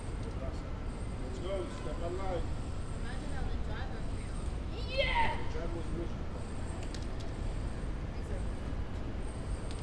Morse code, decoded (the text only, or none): none